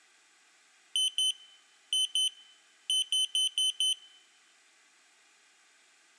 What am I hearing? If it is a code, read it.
Beep code, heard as a piezo beeper, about 3050 Hz. 2-2-5.